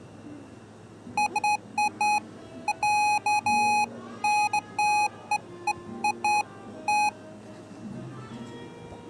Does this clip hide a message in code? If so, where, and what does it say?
No, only beeps of irregular length, with the noise of a cafe.